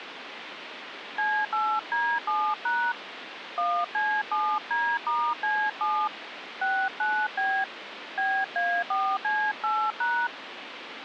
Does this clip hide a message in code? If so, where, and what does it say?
Yes: DTMF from 1.2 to 10.3 s, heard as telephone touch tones, dialled by hand, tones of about 270 ms, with phone line noise. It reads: C8D7# 1C7D*C7 69B BA4C8#